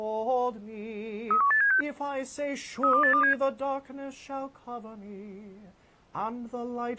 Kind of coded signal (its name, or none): five-tone selective call